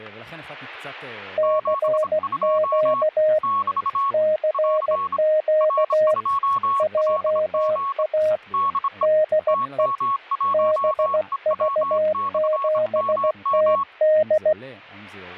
Morse code, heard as two keyed tones, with static crashes and speech in Hebrew. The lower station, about 16 wpm, 620 Hz: CQ CQ JA DE BV7TD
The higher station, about 26 wpm, 1100 Hz: 72 <BT> <AR> R2LG DE TM1EW/MM